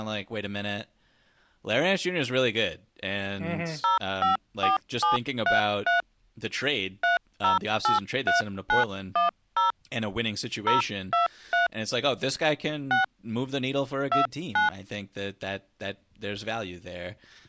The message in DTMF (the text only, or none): 054733 3083910 023 6 29